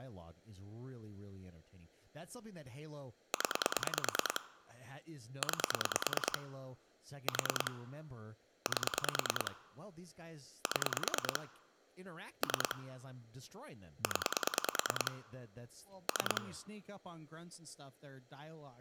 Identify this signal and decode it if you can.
Pulse dialling, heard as clicks on a phone line, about 9 pulses a second, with speech in English. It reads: 0 9 4 8 7 3 0 3